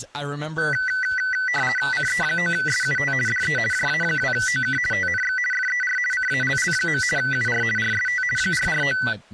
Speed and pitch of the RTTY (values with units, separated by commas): 50 baud, 450 Hz shift, 1750 Hz centre